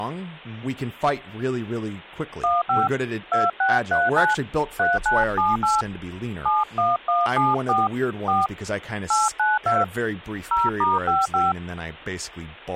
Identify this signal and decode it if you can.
DTMF, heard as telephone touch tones, dialled by hand, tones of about 180 ms, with hum and speech in English. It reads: 15 2639 3978 71174 4 892 0*55